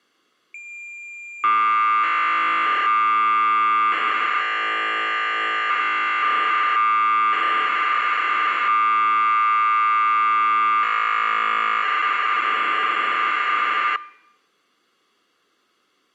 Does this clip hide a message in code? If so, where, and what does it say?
Yes: cassette data (Kansas City type), 1200 baud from 0.5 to 14.0 s, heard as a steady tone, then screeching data.